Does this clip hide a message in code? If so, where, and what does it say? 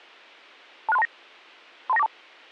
Yes: five-tone selective call (EIA) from 0.9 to 2.1 s, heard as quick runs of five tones, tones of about 30 ms. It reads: 26329 32942